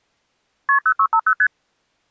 Multi-frequency trunk signalling (R1, as on North American trunks), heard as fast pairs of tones, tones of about 70 ms. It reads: KP 0650 ST